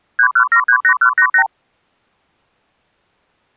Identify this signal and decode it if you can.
Multi-frequency trunk signalling (R2, with the far end's replies), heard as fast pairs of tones, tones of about 80 ms. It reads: 31738188